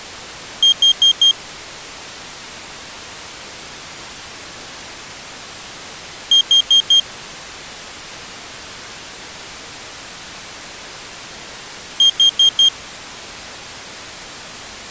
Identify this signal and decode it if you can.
Alarm pattern, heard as an alarm's beeps, played three times, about 3200 Hz. Temporal four. Carbon monoxide.